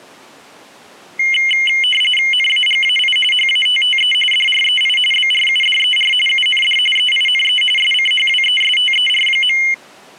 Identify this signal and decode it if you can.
RTTY (45.45 baud, 850 Hz shift), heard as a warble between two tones, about 2550 Hz centre. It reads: NAGAI HATTE DREI BRUDER UND EINE SCHWESTER.